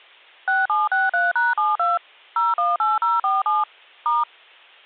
DTMF, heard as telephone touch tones, dialled by machine, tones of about 180 ms. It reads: 6763#72 018047 *